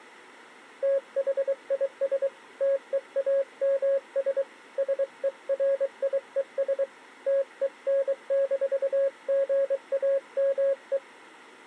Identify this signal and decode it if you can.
Morse code, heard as a keyed tone, hand-sent with a paddle, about 23 wpm, 550 Hz. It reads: THIS TEAMS SERIES TEN-GAME